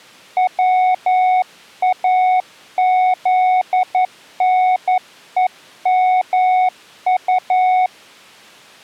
Morse code, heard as a keyed tone, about 11 wpm, 740 Hz. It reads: WAZNEMU